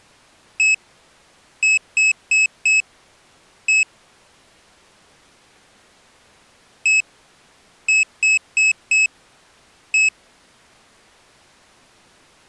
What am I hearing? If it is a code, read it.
Beep code, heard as a piezo beeper, played twice, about 2600 Hz. 1-4-1. In Phoenix BIOS tables: address line failure in the first 64 KB of memory.